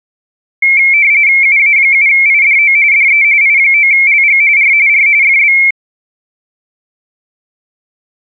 RTTY (45.45 baud, 170 Hz shift), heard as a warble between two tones, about 2250 Hz centre. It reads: UA7IDO DE I9LG R R FB